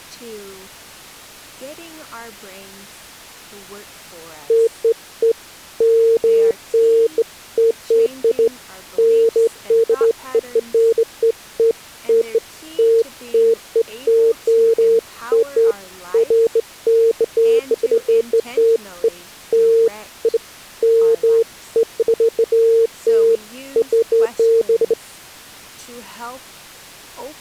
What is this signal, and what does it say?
Beeps of irregular length, with speech in English. There is no code.